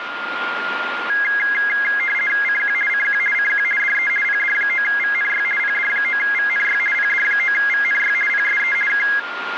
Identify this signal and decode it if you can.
RTTY (50 baud, 450 Hz shift), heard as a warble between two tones, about 1900 Hz centre, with radio static and a steady whistle near 1410 Hz. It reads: CQ CQ CQ DE PD9VNY PD9VNY PD9VNY PSE K